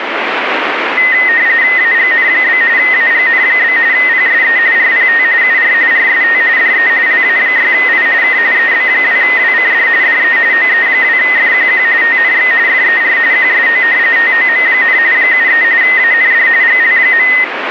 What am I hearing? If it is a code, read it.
RTTY (45.45 baud, 170 Hz shift), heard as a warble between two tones, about 1950 Hz centre, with radio static. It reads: AGN? AGN? PSE RPT UR RST DE LA6I K EB2WCD DE OE2FQQ TNX FER QSO TOM, 73 AND GL.